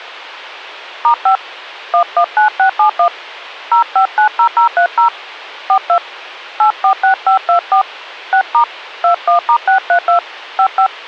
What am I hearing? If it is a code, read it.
DTMF, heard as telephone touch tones, dialled by hand, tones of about 100 ms. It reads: *5 119671 0590030 42 846524 6* 21*632 55